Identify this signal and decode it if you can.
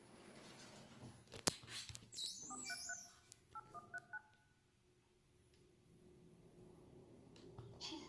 DTMF, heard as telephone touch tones, dialled by machine, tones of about 50 ms, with room echo and the noise inside a lift. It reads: 433 8139